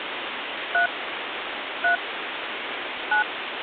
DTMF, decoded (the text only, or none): 3 3 9